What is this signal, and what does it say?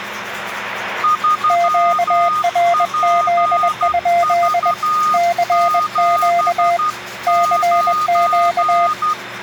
Morse code, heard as two keyed tones, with radio static and the noise of a restroom. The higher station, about 12 wpm, 1230 Hz: 3PV79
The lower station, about 21 wpm, 690 Hz: QRZ? CQ CQ